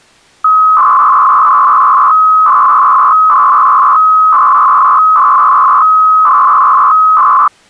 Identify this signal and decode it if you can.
300-baud modem data (Bell 103 tones), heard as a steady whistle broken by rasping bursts, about 300 baud, 200 Hz shift.